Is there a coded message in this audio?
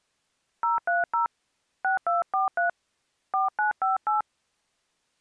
Yes: DTMF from 0.6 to 4.2 s, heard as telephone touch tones, dialled by hand, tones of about 150 ms. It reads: 030 6243 4958